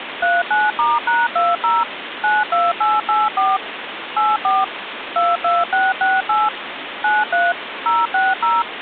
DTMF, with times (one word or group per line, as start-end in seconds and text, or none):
0.2-1.8 39*#20
2.2-3.6 92884
4.2-4.6 84
5.2-6.5 22668
7.0-7.5 93
7.9-8.6 060